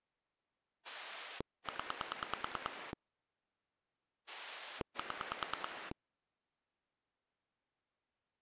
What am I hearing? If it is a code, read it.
Pulse dialling, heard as a rotary dial, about 9 pulses a second. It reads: 0 7